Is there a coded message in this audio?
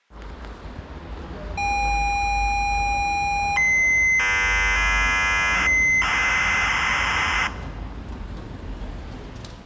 Yes: ZX Spectrum tape loading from 1.6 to 7.5 s, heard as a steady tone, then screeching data, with room echo and the noise inside a lift.